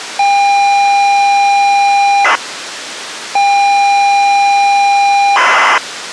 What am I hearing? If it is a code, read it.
ZX Spectrum tape loading, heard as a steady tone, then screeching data, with tape hiss.